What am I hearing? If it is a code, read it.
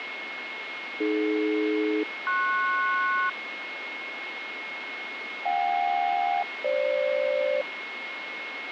Aircraft SELCAL, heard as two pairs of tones, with radio static and a steady whistle near 2170 Hz. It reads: AD-PS JK-FG